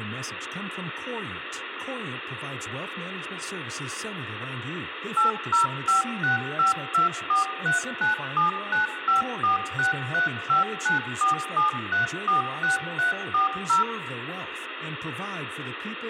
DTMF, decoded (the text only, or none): 8056524397954635947346340